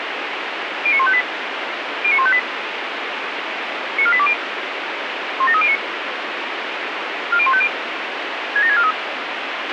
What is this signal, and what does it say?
Five-tone selective call (ZVEI), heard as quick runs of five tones, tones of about 70 ms, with radio hiss and a squelch burst at the end. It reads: 09158 09158 94820 17309 40150 67643